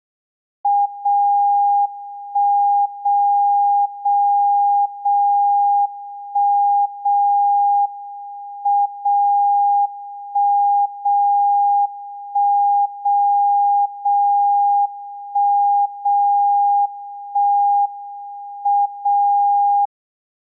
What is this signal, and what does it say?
Radio time signal (WWVB), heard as a tone whose level steps once a second, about 810 Hz. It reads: 0 1 0 0 0 1 0 M 0 1 0 1 0 0 1 0 1 M 0